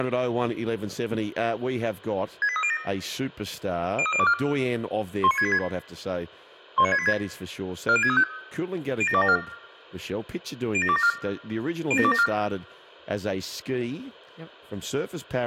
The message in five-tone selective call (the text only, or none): 68307 03024 19686 19686 40635 07274 07274 07274